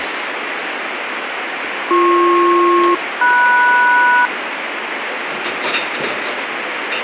Aircraft SELCAL, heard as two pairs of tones, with radio static and kitchen noise. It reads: BP-MS